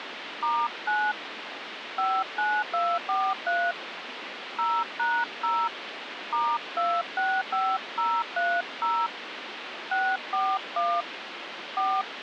DTMF, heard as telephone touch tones, dialled by hand, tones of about 250 ms, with phone line noise. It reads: *9 59243 0#0 *265030 641 4